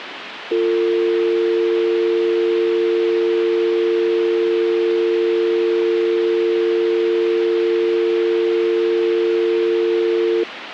Telephone call progress tone (North American or UK plan), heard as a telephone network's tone, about 350, 450 Hz, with phone line noise. Dial tone.